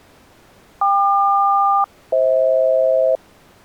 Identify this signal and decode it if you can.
Aircraft SELCAL, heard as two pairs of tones. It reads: KQ-FH